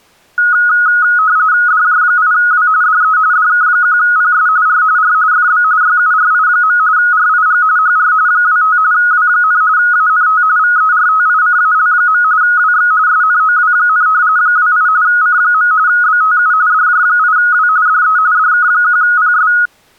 RTTY (45.45 baud, 170 Hz shift), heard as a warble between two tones, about 1360 Hz centre. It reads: DJ8W DE DK1PS R R FB YURI. RIG HR 25 W, ANT VERTICAL. WX SNOW, 28 C. BTU DJ8W DE DK1PS